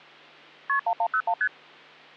Multi-frequency trunk signalling (R1, as on North American trunks), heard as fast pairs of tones, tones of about 70 ms, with hum. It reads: KP 1101 ST